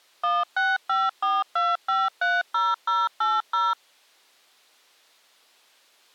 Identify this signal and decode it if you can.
DTMF, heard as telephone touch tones, dialled by machine, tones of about 200 ms. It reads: 16542530080